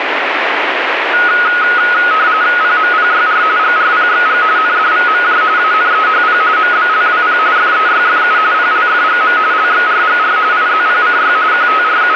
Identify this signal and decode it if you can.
RTTY (45.45 baud, 170 Hz shift), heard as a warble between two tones, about 1360 Hz centre, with radio static. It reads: PMPYR GRPXG NDVMJ ANEHP MBLWP FEYFU PLFGM LXRGR IZPCY …